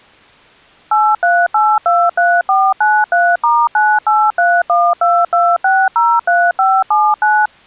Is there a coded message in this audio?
Yes: DTMF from 0.9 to 7.5 s, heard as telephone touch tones, dialled by machine, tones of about 240 ms. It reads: 83823493*983122603579